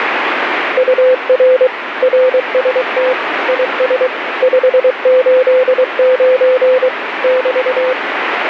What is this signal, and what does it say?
Morse code, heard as a keyed tone, machine-sent, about 23 wpm, 510 Hz, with radio static. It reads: UR RST IS 589 <BT>